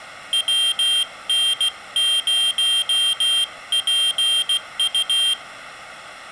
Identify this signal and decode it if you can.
Morse code, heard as a high beeper, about 16 wpm, 3200 Hz. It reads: WN0PU